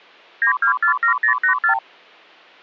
Multi-frequency trunk signalling (R2, with the far end's replies), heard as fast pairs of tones, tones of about 100 ms. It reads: 9247084